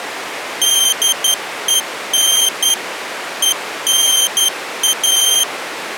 Morse code, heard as a high beeper, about 11 wpm, 3150 Hz. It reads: DEN ENA